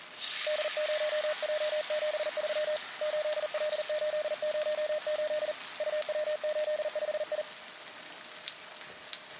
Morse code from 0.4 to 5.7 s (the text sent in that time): D0J73 8L808